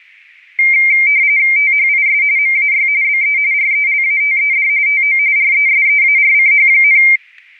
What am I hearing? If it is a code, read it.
RTTY (45.45 baud, 170 Hz shift), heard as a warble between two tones, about 2200 Hz centre, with static crashes. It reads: THIS MAY BE RELATED TO RESEARCH,